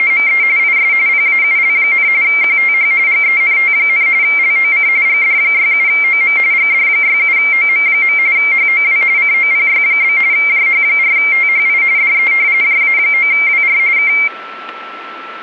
RTTY (45.45 baud, 170 Hz shift), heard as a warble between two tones, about 2200 Hz centre, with static crashes and a steady whistle near 1330 Hz. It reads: … IS PAUL, QTH GENT, LOC GD67OM GD67OM. HOW COPY? JH4THI DE JA9WR K